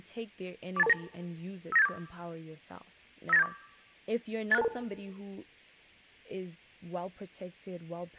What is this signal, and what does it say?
Five-tone selective call (EIA), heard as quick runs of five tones, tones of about 30 ms, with speech in English. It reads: 48229 59874 59874 86622